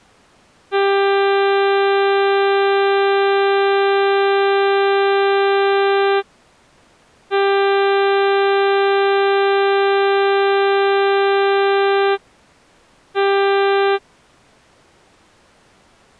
Ship horn signal, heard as a ship's horn, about 400 Hz. 2 long, 1 short. At sea: I intend to overtake on your starboard side.